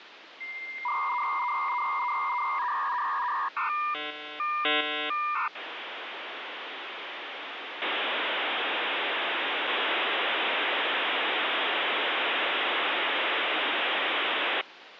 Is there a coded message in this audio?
Yes: dial-up modem handshake (V.34 or later) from 0.4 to 14.6 s, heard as a whistle, warbles, then hiss, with phone line noise.